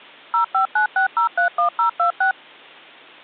DTMF, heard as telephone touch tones, dialled by machine, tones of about 110 ms. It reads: 0596031026